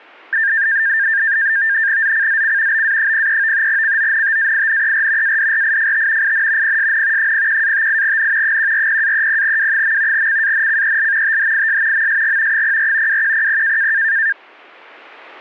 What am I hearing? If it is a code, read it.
NAVTEX (SITOR-B), 100 baud, 170 Hz shift, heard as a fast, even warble, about 1700 Hz centre. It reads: ZCZC BA03 CONTAINER ADRIFT IN PSN 01-58N 140-30W. CANCEL THIS MSG 04 2100